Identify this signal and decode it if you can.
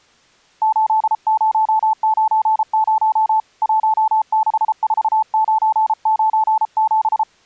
Morse code, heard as a keyed tone, hand-sent with a paddle, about 33 wpm, 870 Hz. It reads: 8090 164997